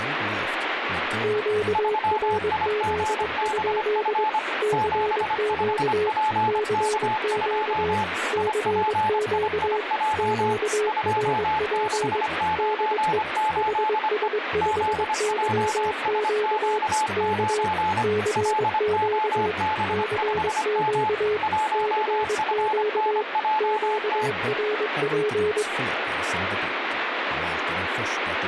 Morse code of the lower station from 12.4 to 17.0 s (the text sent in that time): DE HS5YQ